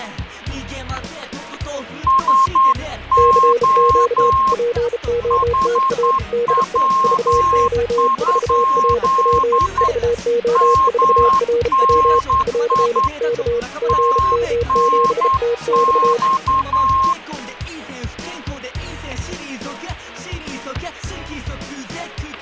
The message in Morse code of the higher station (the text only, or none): SO HW? MNI TNX